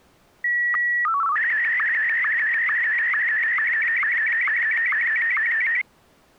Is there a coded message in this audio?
Yes: SSTV (slow-scan television), Martin M1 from 0.4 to 5.8 s, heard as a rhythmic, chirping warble.